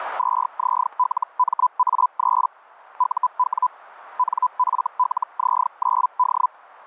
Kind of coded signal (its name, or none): Hellschreiber